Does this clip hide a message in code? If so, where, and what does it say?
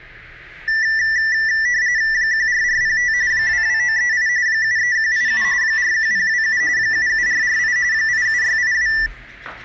Yes: RTTY (45.45 baud, 170 Hz shift) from 0.7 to 9.1 s, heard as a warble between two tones, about 1850 Hz centre, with the noise inside a lift. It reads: 14405 22938 73187 41027 77448 87682